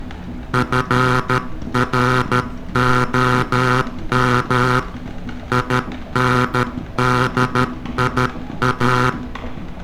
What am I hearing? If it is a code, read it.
Morse code, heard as a buzzer, hand-sent with a paddle, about 13 wpm, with room echo and street noise. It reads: FROM INDIA